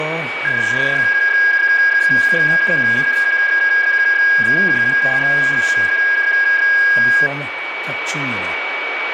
PSK31 (31.25 baud), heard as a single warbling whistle, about 1650 Hz, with radio static and a steady whistle near 2270 Hz.